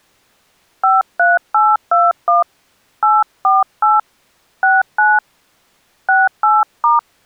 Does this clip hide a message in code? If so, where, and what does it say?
Yes: DTMF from 0.8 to 7.0 s, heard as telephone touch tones, dialled by hand, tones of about 200 ms. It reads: 53821 848 69 68*